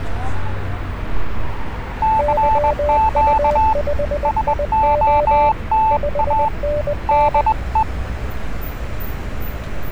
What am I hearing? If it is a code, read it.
Morse code, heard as two keyed tones, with street noise. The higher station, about 20 wpm, 880 Hz: CQ SOTA DE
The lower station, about 20 wpm, 590 Hz: YU5IO 5NN